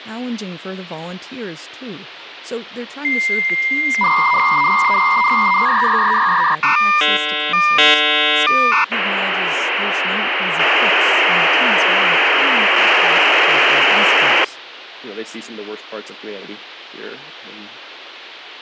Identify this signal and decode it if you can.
Dial-up modem handshake (V.34 or later), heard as a whistle, warbles, then hiss, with phone line noise and speech in English.